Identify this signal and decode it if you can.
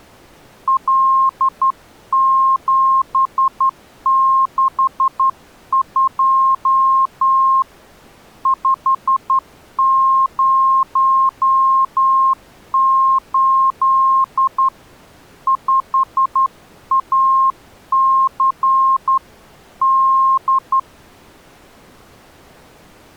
Morse code, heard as a keyed tone, hand-sent with a straight key, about 11 wpm, 1060 Hz. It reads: L762 508 5AC D